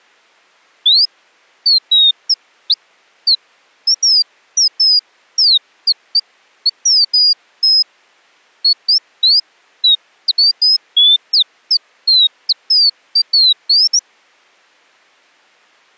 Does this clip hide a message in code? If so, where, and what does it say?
No, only bird-like chirps.